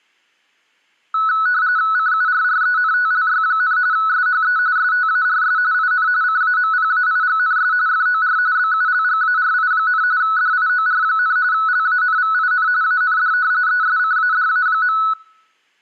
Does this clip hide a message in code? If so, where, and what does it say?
Yes: RTTY (45.45 baud, 170 Hz shift) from 1.1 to 15.1 s, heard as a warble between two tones, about 1390 Hz centre. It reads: CURRENTLY, SHE STARS IN CAMPAIGNS FOR BULGARI, DIOR, LANVIN AND ESCADA.